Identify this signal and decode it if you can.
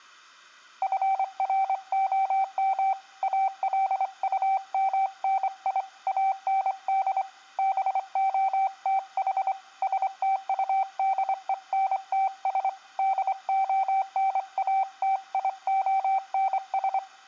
Morse code, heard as a keyed tone, hand-sent with a straight key, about 25 wpm, 770 Hz, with room echo. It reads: FROM ALUMNI AND BOTH STUDENTS DONATIONS